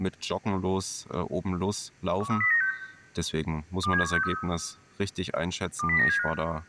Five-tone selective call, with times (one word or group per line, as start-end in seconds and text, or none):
2.2-2.7 13096
3.8-4.3 27163
5.8-6.3 20975